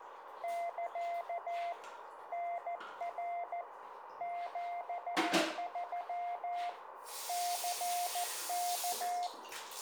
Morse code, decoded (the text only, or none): <KA> NR 73 CK